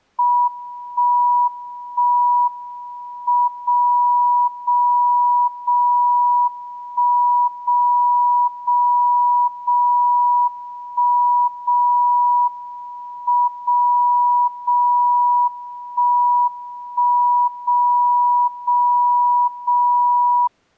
Radio time signal (WWVB), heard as a tone whose level steps once a second, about 970 Hz. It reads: 1 1 M 0 0 0 1 0 0 0 1 0 M 0 0 1 1 0 0 0